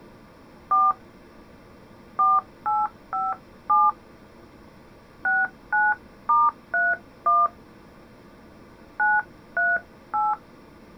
DTMF, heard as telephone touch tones, dialled by hand, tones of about 200 ms. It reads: 4 4857 69*31 938